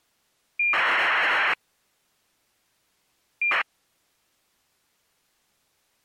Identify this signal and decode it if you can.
ACARS aircraft data, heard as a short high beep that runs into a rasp, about 2400 baud.